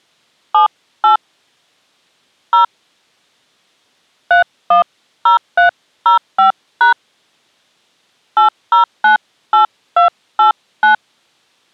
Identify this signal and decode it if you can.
DTMF, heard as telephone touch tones, dialled by hand, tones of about 120 ms. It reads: 78 0 310305# 8098289